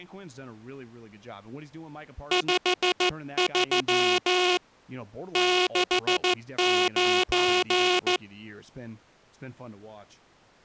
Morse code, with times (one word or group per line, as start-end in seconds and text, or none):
2.3-4.6 53
5.4-8.2 69